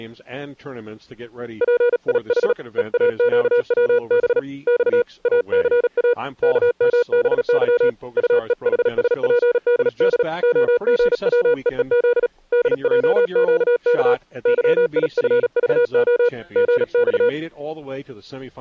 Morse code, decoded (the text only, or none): PIH EAQWB X ACA KMBY UEHSPDD OGWEEZ DJQK YIFVO GX